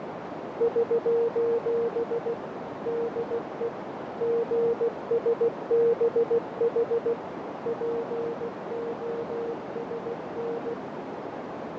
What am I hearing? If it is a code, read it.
Morse code, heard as a keyed tone, machine-sent, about 16 wpm, 470 Hz, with heavy radio static, fading and a narrow filter. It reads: <SOS> DE GSBH POSN